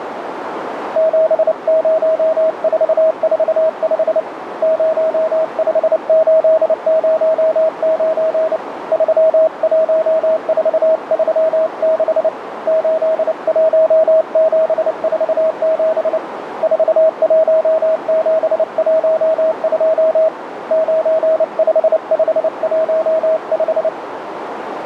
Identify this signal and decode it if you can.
Morse code, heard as a keyed tone, hand-sent with a paddle, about 29 wpm, 640 Hz, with radio static and a narrow filter. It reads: 70445 05809 31436 81747 41712 95515